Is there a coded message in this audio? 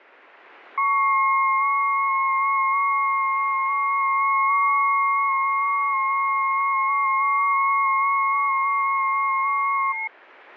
Yes: FT8 (several signals at once) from 0.8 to 10.1 s, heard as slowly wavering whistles, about 6.25 baud.